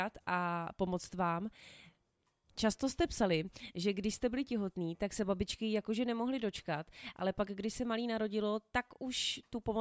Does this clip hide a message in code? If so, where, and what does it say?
No, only speech in Czech.